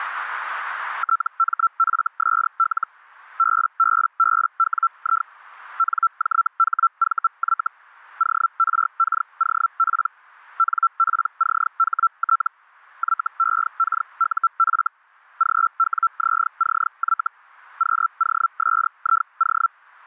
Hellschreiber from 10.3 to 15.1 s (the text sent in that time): NPCHT YEKUF